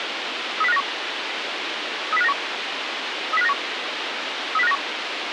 Five-tone selective call (EEA), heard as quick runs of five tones, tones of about 40 ms, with radio hiss. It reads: 30591 30591 30591 30591